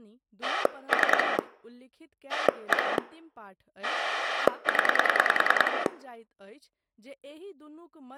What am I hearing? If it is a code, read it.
Pulse dialling, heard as a rotary dial, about 10 pulses a second, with speech in Maithili. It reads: 3 1 0